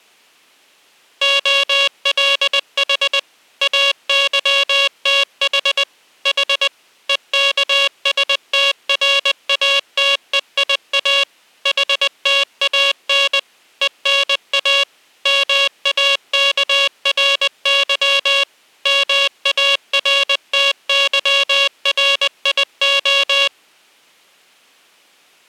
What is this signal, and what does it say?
Morse code (Greek alphabet), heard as a buzzer, machine-sent, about 20 wpm. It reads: ΟΛΗ ΑΥΤΗ Η ΕΚΣΤΡΑΤΕΙΑ ΗΤΑΝ ΕΝΑ ΜΑΚΡΥ ΜΑΡΤΥΡΙΟ